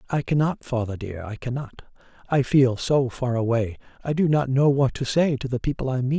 Speech in English. There is no code.